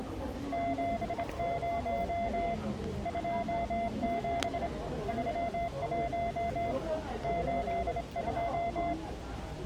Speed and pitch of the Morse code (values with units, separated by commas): 25 wpm, 690 Hz